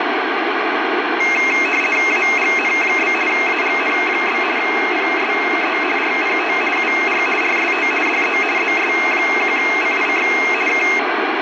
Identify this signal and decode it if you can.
RTTY (50 baud, 450 Hz shift), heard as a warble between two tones, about 2350 Hz centre, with radio static. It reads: AGN? AGN? PSE RPT UR RST DE ZS1CIX K